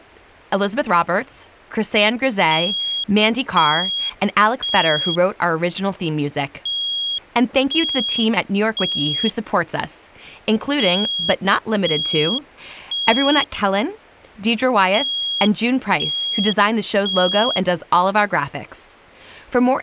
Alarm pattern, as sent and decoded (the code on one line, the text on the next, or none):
3 beeps and a pause
temporal three